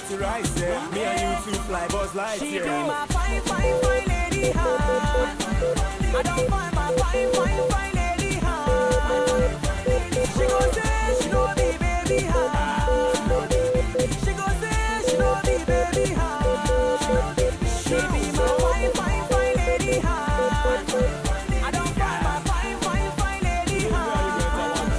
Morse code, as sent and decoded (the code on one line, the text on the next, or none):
- .... . .. .-. / -- ..- ... .. -.-. / -... .-.. . -. -.. ...
THEIR MUSIC BLENDS